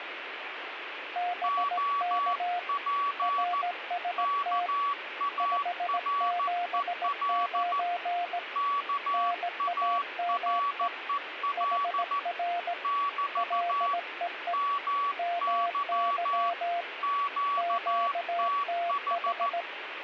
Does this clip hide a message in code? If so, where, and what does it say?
Yes: Morse code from 1.1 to 19.7 s, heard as two keyed tones, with radio static. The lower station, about 17 wpm, 700 Hz: BK RST 579 NAME HR LEE MY QTH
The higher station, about 14 wpm, 1140 Hz: OP KAREL KAREL <BT> MY QTH